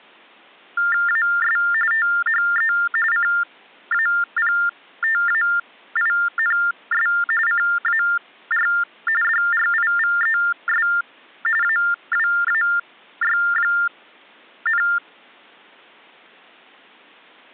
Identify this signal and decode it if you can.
TTY/TDD text telephone tones (45.45 baud Baudot), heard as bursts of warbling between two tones, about 400 Hz shift, 1600 Hz centre. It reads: AS THE CAPTAINS CAR DRIVES AWAY,